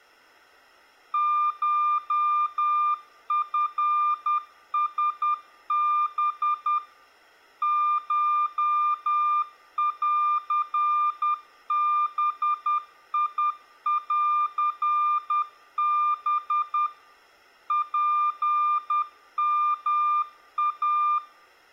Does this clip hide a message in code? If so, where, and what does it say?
Yes: Morse code (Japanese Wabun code) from 1.1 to 21.2 s, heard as a keyed tone, machine-sent, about 10 wpm, 1200 Hz. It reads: コチラハ コンバンハ ツヨイ